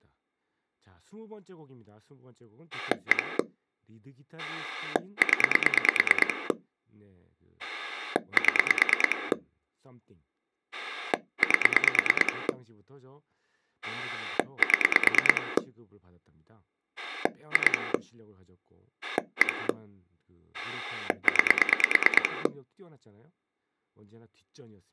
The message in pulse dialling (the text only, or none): 1 0 7 8 7 2 1 9